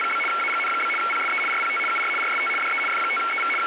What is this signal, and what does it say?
RTTY (75 baud, 850 Hz shift), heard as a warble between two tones, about 1800 Hz centre, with radio static. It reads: … AGN? PSE RPT UR RST DE F5EV …